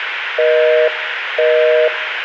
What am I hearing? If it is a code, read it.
Telephone call progress tone (North American plan), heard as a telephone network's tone, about 480, 620 Hz, 0.5 s on and 0.5 s off. Busy tone.